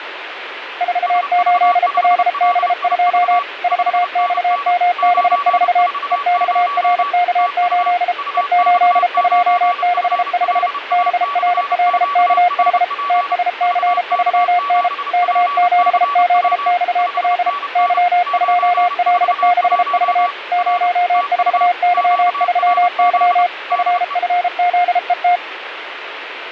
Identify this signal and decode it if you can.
Morse code, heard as two keyed tones, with radio static. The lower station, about 33 wpm, 710 Hz: 48LB2 4XMB4 EXRK8 E8265 BRLKH TSC3N K7ZXL Y2L6V 04Y3Y FFZET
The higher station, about 30 wpm, 1140 Hz: SV5LIV 5NN 940 TU UX9FLA/QRP VK7PCW 5NN 941 R TU QRZ DE